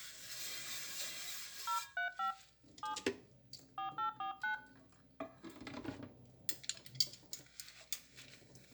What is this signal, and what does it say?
DTMF, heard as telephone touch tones, dialled by hand, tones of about 120 ms, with room echo and kitchen noise. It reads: 035 7 4849